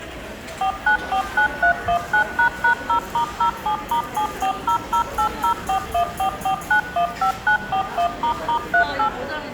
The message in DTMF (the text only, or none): 4949319##0*07*7400804144915941**38